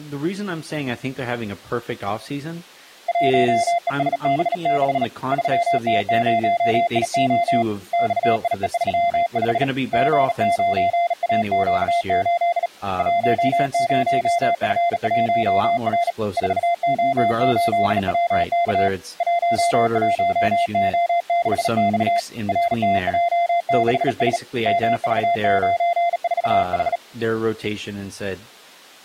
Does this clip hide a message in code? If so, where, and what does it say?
Yes: Morse code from 3.0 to 27.0 s, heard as a keyed tone, hand-sent with a bug key, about 37 wpm, 690 Hz, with speech in English. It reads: 1ESB6 3T0IO XIE35 G9AQ8 10F1R 4O8WK 11O6X RTJ6S MV94H